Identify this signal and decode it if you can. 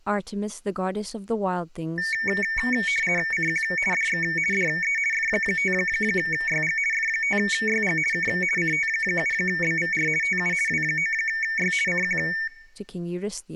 RTTY (50 baud, 450 Hz shift), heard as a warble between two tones, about 2000 Hz centre, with speech in English. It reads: CQ DX DE F5YG F5YG K CT7BVR TU W9Y CQ